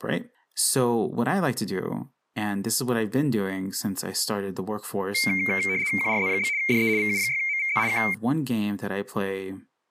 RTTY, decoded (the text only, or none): QRZ? DE VU6MVZ K